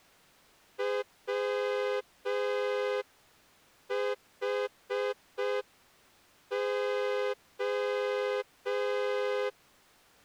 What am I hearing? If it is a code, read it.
Morse code, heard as a horn, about 5 wpm. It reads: WHO